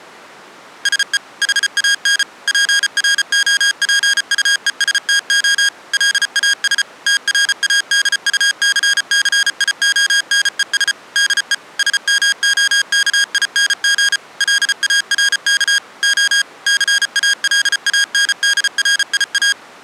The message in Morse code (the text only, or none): SE HAN PROPUESTO LAS TRADUCCIONES DE SMOKING LARK O CALANDRIA